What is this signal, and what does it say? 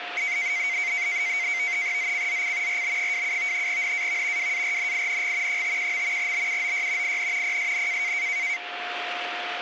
NAVTEX (SITOR-B), 100 baud, 170 Hz shift, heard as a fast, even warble, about 2150 Hz centre, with radio static and a steady whistle near 710 Hz. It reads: ZCZC RB27 NAV WARNING 51. BUOY IN PSN